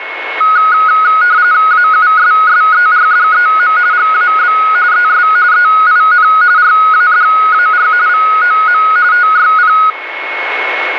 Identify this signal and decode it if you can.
RTTY (45.45 baud, 170 Hz shift), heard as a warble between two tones, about 1360 Hz centre, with radio static and a steady whistle near 2190 Hz. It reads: AUSSERDEM GAB ES EIN RADAR VOM TYP